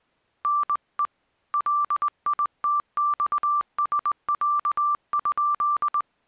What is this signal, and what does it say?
Morse code (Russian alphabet), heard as a keyed tone, hand-sent with a straight key, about 20 wpm, 1170 Hz. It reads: НЕ ЛИТЬСЯ?